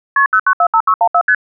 Multi-frequency trunk signalling (R1, as on North American trunks), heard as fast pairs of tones, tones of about 70 ms. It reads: KP 0945614 ST